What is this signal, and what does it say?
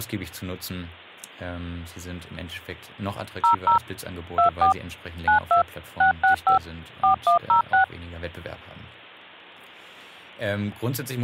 DTMF, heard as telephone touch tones, dialled by machine, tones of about 110 ms, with speech in German. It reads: 00 24 92 665 4106